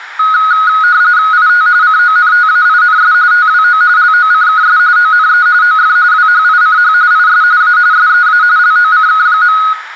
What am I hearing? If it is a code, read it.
RTTY (45.45 baud, 170 Hz shift), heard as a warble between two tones, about 1360 Hz centre, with radio static. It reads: IT CONTAINS TWO LOCKS ONE OF WHICH IS A SEA LOCK.